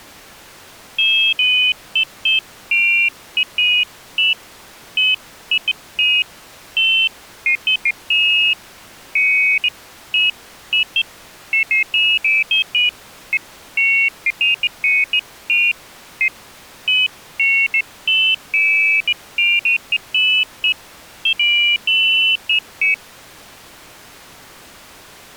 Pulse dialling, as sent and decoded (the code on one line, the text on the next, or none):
none